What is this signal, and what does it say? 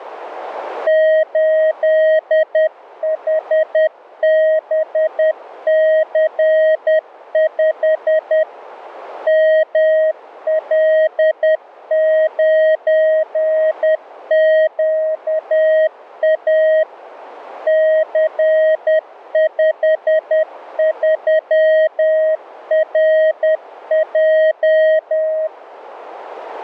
Morse code, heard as a keyed tone, machine-sent, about 10 wpm, 630 Hz, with radio static. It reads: 8HBC5 ML9QA C53RJ